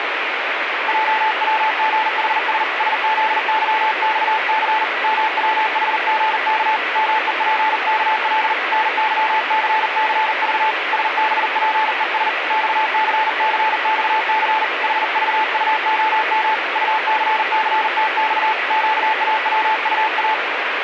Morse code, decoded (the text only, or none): JWGHS SZYXC MWHGK MEPKL NYCCV SBPES XCCXC HVUOM UCCTX QAWUA